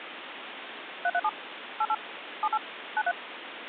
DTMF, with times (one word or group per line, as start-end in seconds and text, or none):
1.0-1.3 337
1.8-1.9 88
2.4-2.6 78
3.0-3.1 93